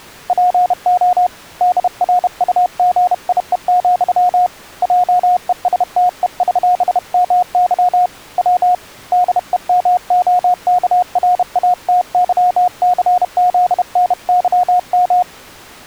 Morse code (with Polish letters), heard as a keyed tone, hand-sent with a bug key, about 31 wpm, 720 Hz. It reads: PO DRUGIE, JESTEŚMY W DEMOKRATYCZNYM